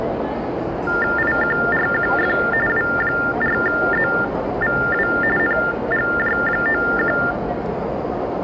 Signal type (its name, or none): TTY/TDD text telephone tones